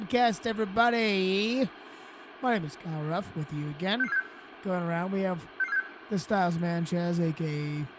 Five-tone selective call (EEA), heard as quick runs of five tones, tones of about 40 ms, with radio hiss, a squelch burst at the end, room echo and speech in English. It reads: 66476 66476